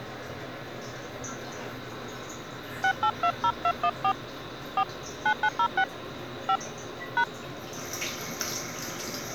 DTMF, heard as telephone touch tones, dialled by hand, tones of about 70 ms, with the noise of a restroom. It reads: 6820214 4 9906 5 #